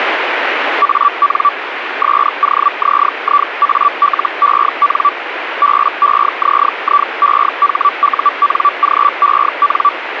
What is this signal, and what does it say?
Hellschreiber (Feld-Hell, 122.5 baud), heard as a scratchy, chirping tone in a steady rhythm, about 1160 Hz, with radio static. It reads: AN SOZIALEN BEZIEHUNGEN